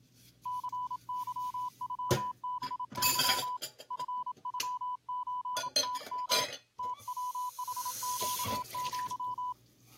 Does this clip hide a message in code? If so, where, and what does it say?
Yes: Morse code (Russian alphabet) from 0.4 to 9.6 s, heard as a keyed tone, hand-sent with a paddle, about 27 wpm, 1000 Hz, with kitchen noise. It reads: ЦЫЮБЫ ФЮЧТМ ТВХЩЪ